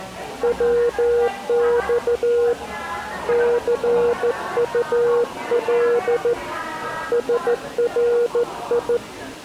Morse code, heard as a keyed tone, hand-sent with a straight key, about 14 wpm, 480 Hz, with the noise of a cafe. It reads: WX CUL SRI